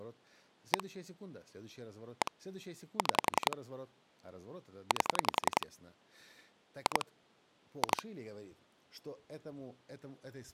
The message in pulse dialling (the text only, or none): 1 1 6 8 2 2